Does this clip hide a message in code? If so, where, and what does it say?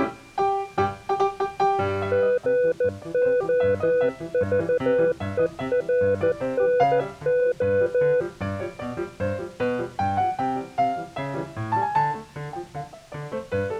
Yes: Morse code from 2.1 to 8.3 s, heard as a keyed tone, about 14 wpm, 500 Hz. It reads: GOVERNO